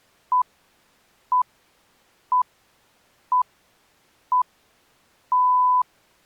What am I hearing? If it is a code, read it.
Radio time signal (six pips, as the Greenwich Time Signal), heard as pips.